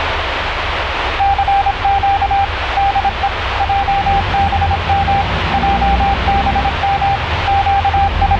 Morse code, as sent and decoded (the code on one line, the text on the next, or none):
-.-. --.- / -.. . / .--- -... -- / .--- -... -- / …
CQ DE JBM JBM …